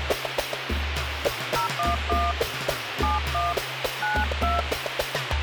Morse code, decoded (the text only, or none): none